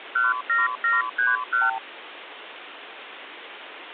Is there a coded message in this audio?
Yes: multi-frequency trunk signalling (R2, with the far end's replies) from 0.2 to 1.8 s, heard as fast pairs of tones, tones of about 170 ms, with phone line noise. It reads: 17731